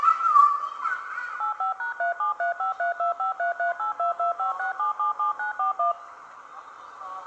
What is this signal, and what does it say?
DTMF, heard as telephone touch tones, dialled by machine, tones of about 120 ms, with the noise of a park. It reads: 85#37353253382256777941